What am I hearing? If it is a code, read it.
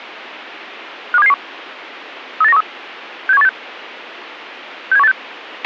Five-tone selective call (EEA), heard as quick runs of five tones, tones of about 40 ms, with a squelch burst at the end. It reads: 52771 38913 67186 67186